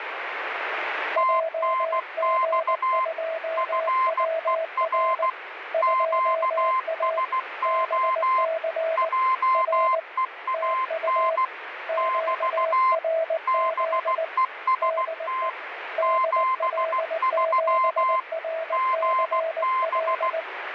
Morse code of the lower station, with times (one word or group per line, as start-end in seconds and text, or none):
1.2-5.3 JG2WR
5.7-7.2 2A
7.7-9.1 BC
9.5-10.0 R
10.5-11.4 TU
11.9-14.2 QRZ
14.8-15.5 DE
16.0-20.4 DL7RCL